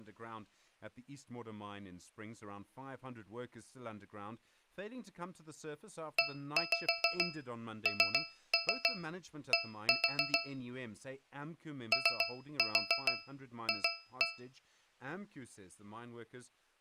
Tap code, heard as taps on a metal pipe, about 7 knocks a second, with speech in English. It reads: END OF